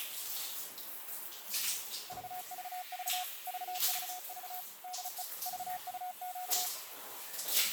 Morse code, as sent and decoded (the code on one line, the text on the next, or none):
...- ...- ...- / ...- ...- ...- / -.. . / ...- ..- --.-
VVV VVV DE VUQ